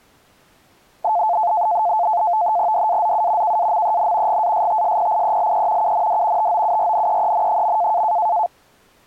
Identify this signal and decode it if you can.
NAVTEX (SITOR-B), 100 baud, 170 Hz shift, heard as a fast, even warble, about 780 Hz centre. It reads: DAZU KAMEN GASTSPIELE UND TOURNEEN.